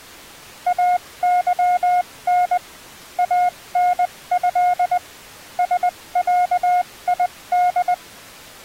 Morse code (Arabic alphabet), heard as a keyed tone, machine-sent, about 20 wpm, spaced as for 17 wpm, 720 Hz. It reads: اظن انه سعيد